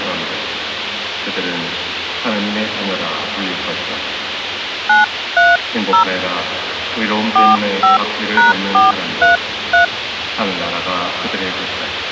DTMF, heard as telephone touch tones, dialled by hand, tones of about 150 ms, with radio hiss and a squelch burst at the end. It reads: 930 45#433